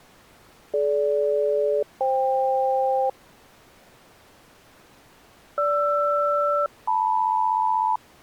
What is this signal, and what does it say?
Aircraft SELCAL, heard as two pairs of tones. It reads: DG-FK GR-LM